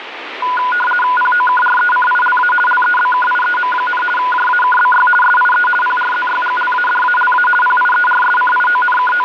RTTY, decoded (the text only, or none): POKRECILA LEBKIEM, JAKBY SIE PRZYGLADALA …